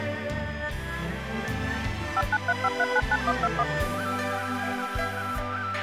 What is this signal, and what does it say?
DTMF, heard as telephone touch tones, dialled by machine, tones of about 50 ms, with a squelch burst at the end. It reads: 5935399121